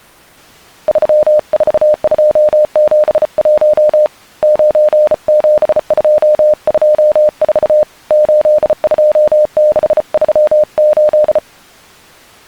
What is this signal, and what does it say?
Morse code, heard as a keyed tone, hand-sent with a bug key, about 34 wpm, 610 Hz. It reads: 34271 97224 82638